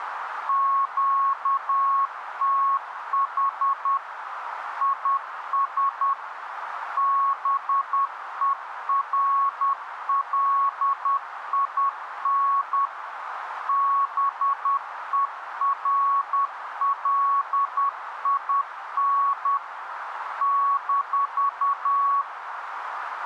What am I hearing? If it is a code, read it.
Morse code, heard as a keyed tone, machine-sent, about 10 wpm, 1110 Hz, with radio static and a narrow filter. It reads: QTH IS BERLIN BERLIN -